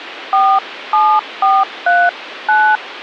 DTMF, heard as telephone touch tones, dialled by hand, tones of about 250 ms, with phone line noise. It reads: 47439